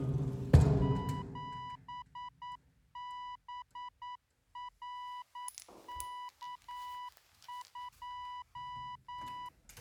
Morse code, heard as a keyed tone, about 9 wpm, 990 Hz, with the noise inside a lift. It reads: 7BRK2